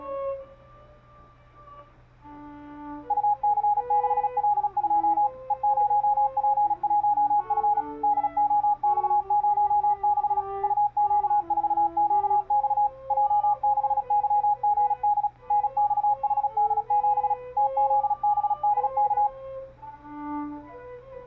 Morse code, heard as a keyed tone, machine-sent, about 36 wpm, 830 Hz. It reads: UC6L2 E0P1F DOX06 UQ4QX J6YGD NXHD7 TZBDK